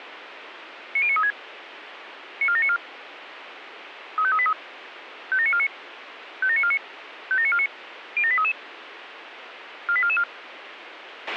Five-tone selective call (ZVEI), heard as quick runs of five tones, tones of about 70 ms, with radio hiss and a squelch burst at the end. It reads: 90936 94794 35383 57949 57949 57949 07833 48444